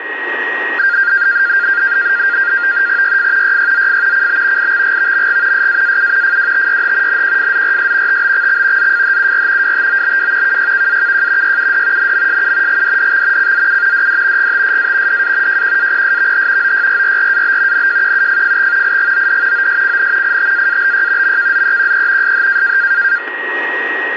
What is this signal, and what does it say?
NAVTEX (SITOR-B), 100 baud, 170 Hz shift, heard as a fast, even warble, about 1500 Hz centre, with radio static and a steady whistle near 1890 Hz. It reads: YF YYZF CB IXGVMG SAAU FWTYH NQFZRS TBXX ZFHUR WTOBW KYKAKJ YUD NMSU GDDX CZU DD GTSA DA JQAPSVH OYRRRAB NJQUFFX IGOD OSCN ITAABY MKZEQE SH